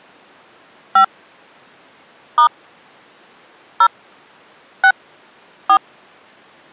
DTMF, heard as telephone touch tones, dialled by hand, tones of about 80 ms. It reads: 5 * 0 6 4